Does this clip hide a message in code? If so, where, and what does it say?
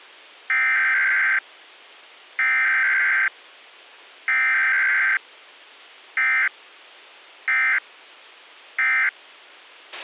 Yes: Emergency Alert System (SAME) tones (header bursts, then end-of-message bursts) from 0.5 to 9.1 s, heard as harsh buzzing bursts, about 520.83 baud, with a squelch burst at the end.